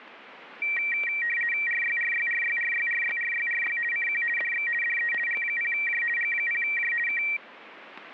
RTTY (50 baud, 450 Hz shift), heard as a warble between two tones, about 2100 Hz centre, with static crashes. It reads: RYRYRYRYRYRYRY CQ DX DE G0J G0J K